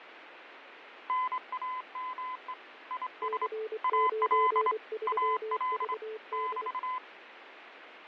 Morse code, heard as two keyed tones, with radio static and fading. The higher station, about 25 wpm, 1020 Hz: NAME IS AL AL <BT>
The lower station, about 24 wpm, 440 Hz: C93VD